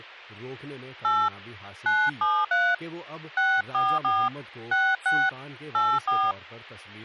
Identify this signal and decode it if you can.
DTMF, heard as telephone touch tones, dialled by hand, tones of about 240 ms, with speech in Urdu. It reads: 8 973 644 66 84